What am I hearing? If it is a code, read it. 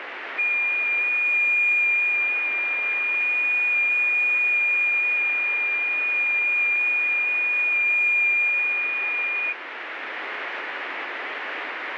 FT8 (one signal), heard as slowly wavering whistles, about 6.25 baud, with radio static.